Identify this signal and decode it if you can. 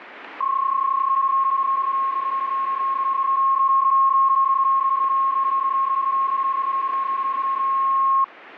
PSK31 (31.25 baud), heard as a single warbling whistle, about 1080 Hz, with radio static.